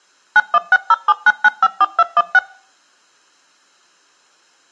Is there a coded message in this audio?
Yes: DTMF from 0.4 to 2.4 s, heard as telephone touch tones, dialled by machine, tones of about 40 ms. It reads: 916079954216